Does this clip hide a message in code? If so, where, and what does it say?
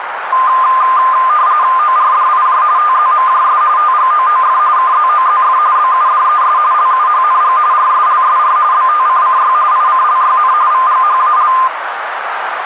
Yes: RTTY (45.45 baud, 170 Hz shift) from 0.3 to 11.7 s, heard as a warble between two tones, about 1120 Hz centre, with radio static and a narrow filter. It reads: ORDIJ TZMJS TGOOF KZOZF BUDES LUHNG RSLSR BTCCY ICLYN VGHAL